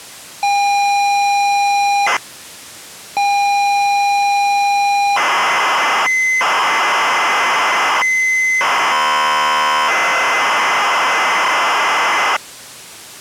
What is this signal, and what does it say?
ZX Spectrum tape loading, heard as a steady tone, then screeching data.